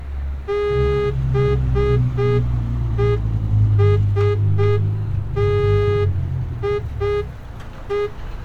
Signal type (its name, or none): Morse code